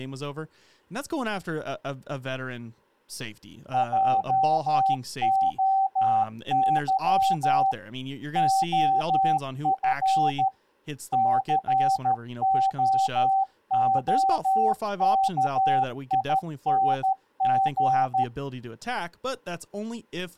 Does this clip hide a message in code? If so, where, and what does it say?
Yes: Morse code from 3.7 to 18.3 s, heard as a keyed tone, machine-sent, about 13 wpm, 770 Hz, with speech in English. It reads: JOY OF COOKING